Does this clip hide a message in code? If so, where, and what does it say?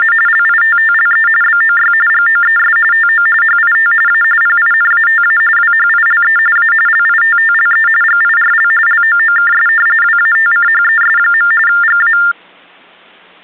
Yes: TTY/TDD text telephone tones (45.45 baud Baudot) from 0.0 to 12.3 s, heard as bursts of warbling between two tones, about 400 Hz shift, 1600 Hz centre. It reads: … LITTLE BOY GOES TO HIT A PINATA WHILE A LITTLE GIRL LOOKS WATCHES. GA